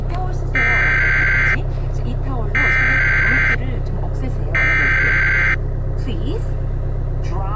Emergency Alert System (SAME) tones (header bursts), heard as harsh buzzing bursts, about 520.83 baud, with the noise inside a car.